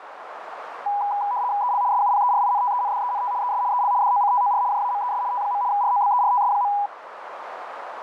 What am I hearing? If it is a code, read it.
RTTY (75 baud, 170 Hz shift), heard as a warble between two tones, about 900 Hz centre, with radio static and a narrow filter. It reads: EL SUPERINTENDENT ES EL DOCTOR JAMES T. ROBERTS.